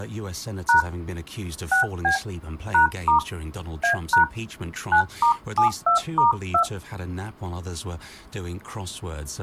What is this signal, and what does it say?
DTMF, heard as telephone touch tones, dialled by hand, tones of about 110 ms. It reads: # 6B #* A# 9*72*2